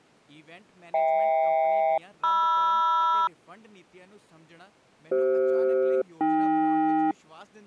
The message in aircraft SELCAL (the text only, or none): HK-MR CF-AK